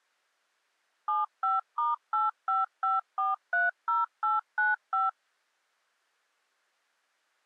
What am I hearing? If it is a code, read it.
DTMF, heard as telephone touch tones, dialled by machine, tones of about 170 ms. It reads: 75*855430895